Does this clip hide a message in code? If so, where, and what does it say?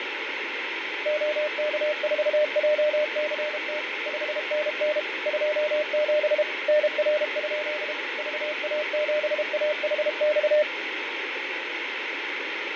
Yes: Morse code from 1.0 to 10.7 s, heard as a keyed tone, machine-sent, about 32 wpm, 600 Hz, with radio static and fading. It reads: OK4JCT 5NN 27 NR? VA7AHX